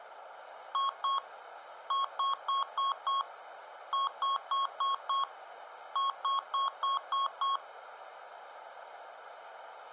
Beep code, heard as beeps from a small speaker, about 1090 Hz. 2-5-5-6.